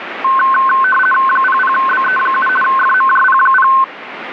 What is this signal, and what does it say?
RTTY (50 baud, 450 Hz shift), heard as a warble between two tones, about 1290 Hz centre, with radio static. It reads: 00BE7 FMJP0